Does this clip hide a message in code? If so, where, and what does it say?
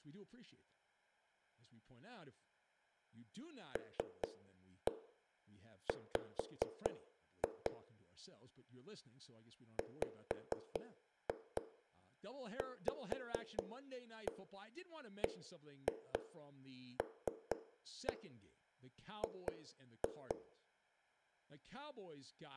Yes: tap code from 3.8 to 20.3 s, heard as knocks on a wall, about 4 knocks a second, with room echo and speech in English. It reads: LW WVBLG